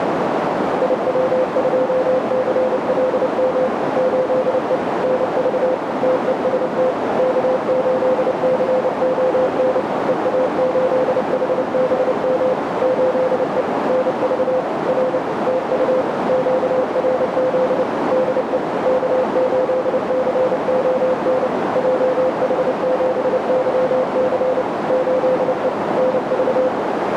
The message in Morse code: IW2CLM 8E NV TEST K8CON EA8HBM 8E NV R TU QRZ DE K8CON JH7YC 8E NV

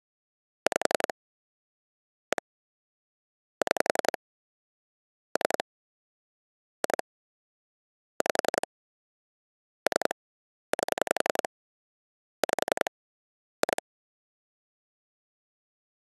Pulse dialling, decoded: 5 1 6 3 2 5 3 8 5 2

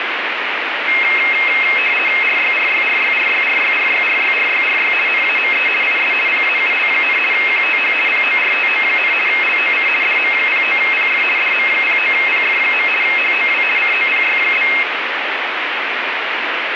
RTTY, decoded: RYRYRYRYRYRYRYRYRY NAME IS PAUL, QTH PORTO, LOC DM09PF DM09PF. HOW COPY?

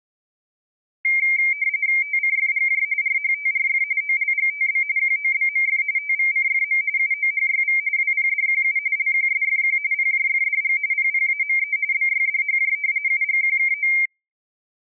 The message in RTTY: TCFGJ RHTRF OLGTB QOBMF TVCFM UOHYV WPDQU LQSFQ PJFDG PPAME BYDHJ UGQKO

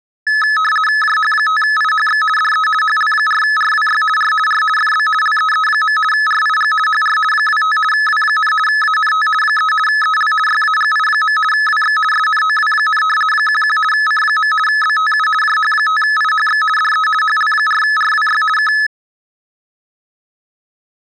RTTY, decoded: JH5IHX DE HL4RWY R R FB LEE. RIG HR 25 W, ANT 3 EL YAGI. WX SNOW, 11 C. BTU JH5IHX DE HL4RWY K

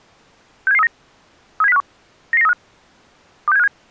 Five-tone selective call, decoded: 67739 37051 99935 26757

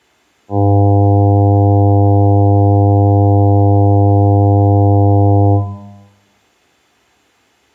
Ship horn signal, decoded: 1 long

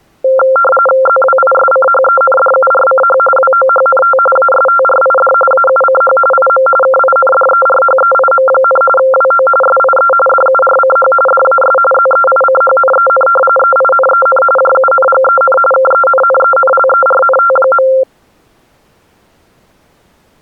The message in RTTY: ZWISCHENDURCH WOHNT ASTRID AUCH IM KINDERHEIM, WO SIE DURCH DAS ZEICHNEN EINEN JUNGEN KENNENLERNT.

